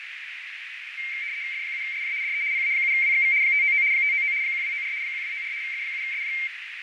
RTTY (75 baud, 170 Hz shift), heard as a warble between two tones, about 2200 Hz centre, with radio static, fading and a narrow filter. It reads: F7SJ DE PA7WXV 599 599 1294 1294 F7SJ